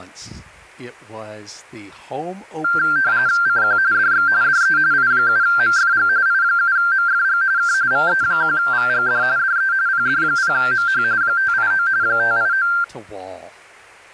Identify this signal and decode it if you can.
RTTY (45.45 baud, 170 Hz shift), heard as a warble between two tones, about 1480 Hz centre. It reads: CQ DX DE I7MFG I7MFG K VE1VGD DE PD0MH 589 589